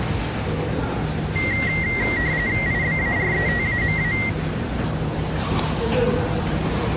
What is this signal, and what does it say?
RTTY (45.45 baud, 170 Hz shift), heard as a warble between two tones, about 2000 Hz centre, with the noise of a subway station. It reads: IBARETAMA